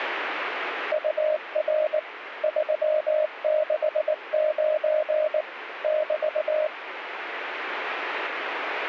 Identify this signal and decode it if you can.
Morse code, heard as a keyed tone, machine-sent, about 19 wpm, 620 Hz, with radio static. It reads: UR 369 <BT>